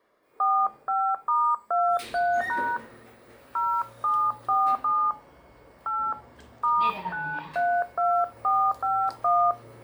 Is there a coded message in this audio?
Yes: DTMF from 0.4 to 9.5 s, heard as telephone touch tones, dialled by hand, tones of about 270 ms, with the noise inside a lift. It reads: 45*23# 0747 8 *932451